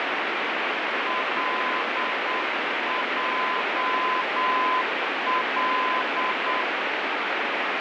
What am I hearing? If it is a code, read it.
Morse code, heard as a keyed tone, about 8 wpm, 1020 Hz, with heavy radio static. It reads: LJL